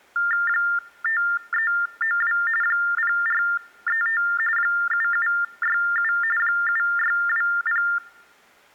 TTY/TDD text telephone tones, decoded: 5392 0435 7767 7620

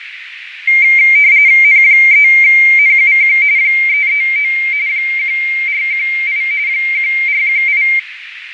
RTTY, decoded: N3NUQ 339 1418 1418

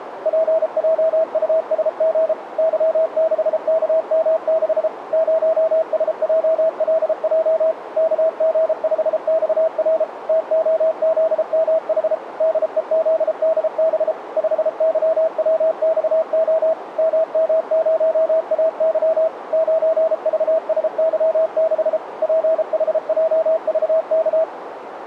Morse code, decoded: PJUSG Y6KM6 0SJLJ KG5XR TOZMH DEZDB 5YWXO MM0AY 9VSY6 PHJVK

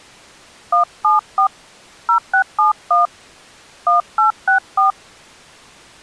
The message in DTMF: 174 0671 1864

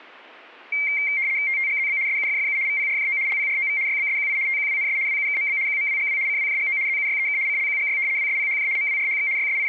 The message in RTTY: TTGZB SUFFU VPRJO LPROV YBSQI TQWNS WUKMB QMWGW CWJGO ZUYEK CLQGY WSPHJ MWRHX …

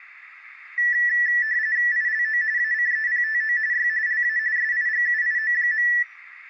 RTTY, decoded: ILO ACEPTO Y LA SIGUIO.

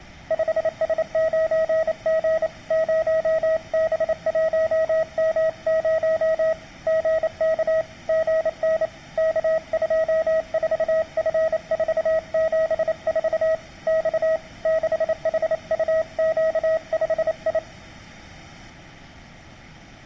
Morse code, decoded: 5S9G 0B1M0 GK GN K24F474 X 6HUQ5I

